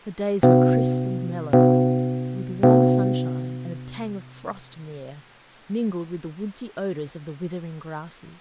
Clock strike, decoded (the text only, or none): 3